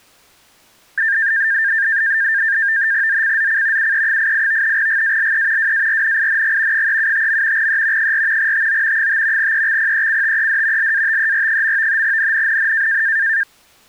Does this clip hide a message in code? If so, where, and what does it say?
Yes: NAVTEX (SITOR-B), 100 baud, 170 Hz shift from 1.0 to 13.4 s, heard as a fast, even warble, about 1700 Hz centre. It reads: ZCZC UE88 GALE WARNING 375. E 4 TO 5 EXPECTED LATER. NNNN